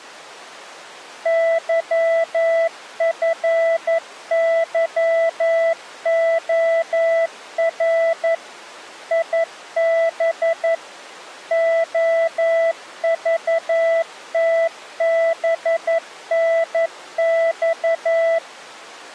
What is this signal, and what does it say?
Morse code, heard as a keyed tone, machine-sent, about 11 wpm, 660 Hz. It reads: YFYOR IB OVTBNX